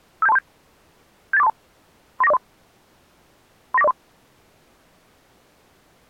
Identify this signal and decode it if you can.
Five-tone selective call (EIA), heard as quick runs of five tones, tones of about 30 ms. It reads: 57237 78432 39403 39403